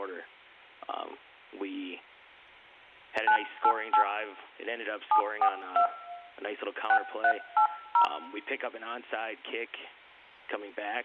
DTMF, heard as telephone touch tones, dialled by hand, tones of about 80 ms, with room echo. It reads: 988 742 6380